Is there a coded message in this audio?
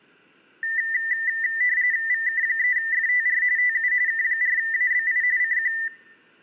Yes: RTTY (45.45 baud, 170 Hz shift) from 0.6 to 5.9 s, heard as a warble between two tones, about 1900 Hz centre. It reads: VK3FTR TU K4ABI CQ